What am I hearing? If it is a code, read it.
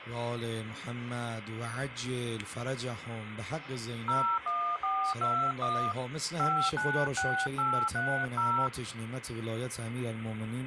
DTMF, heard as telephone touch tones, dialled by hand, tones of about 300 ms, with phone line noise. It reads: 01421 596830